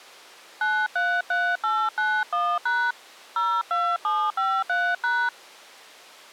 DTMF, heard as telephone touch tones, dialled by hand, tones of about 250 ms. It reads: 933891# 02753#